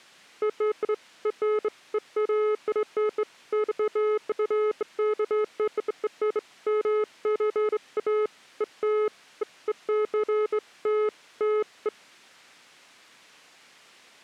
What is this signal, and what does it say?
Beeps of irregular length. There is no code.